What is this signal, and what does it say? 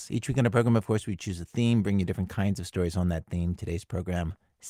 Speech in English. There is no code.